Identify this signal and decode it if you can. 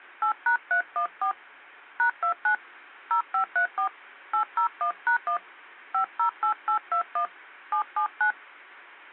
DTMF, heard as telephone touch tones, dialled by hand, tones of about 100 ms. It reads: 8#314 #29 0534 801#1 508821 779